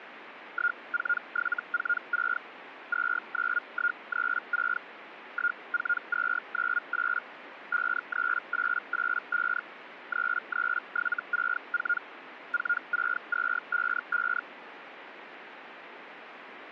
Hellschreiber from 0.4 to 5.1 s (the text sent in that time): 14746 29136